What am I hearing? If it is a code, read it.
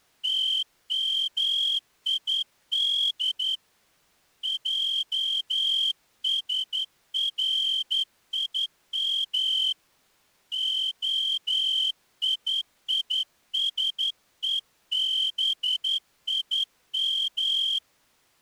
Morse code (Hebrew alphabet), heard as a whistle, hand-sent with a straight key, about 11 wpm. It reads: תמיד עשרים היישובים